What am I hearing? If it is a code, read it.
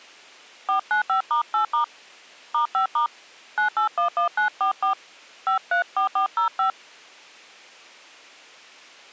DTMF, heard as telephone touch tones, dialled by hand, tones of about 110 ms. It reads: 495*8* *5* 9811944 534405